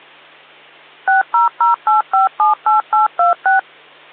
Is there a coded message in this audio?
Yes: DTMF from 1.1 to 3.6 s, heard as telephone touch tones, dialled by machine, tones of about 140 ms, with hum. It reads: 6008578826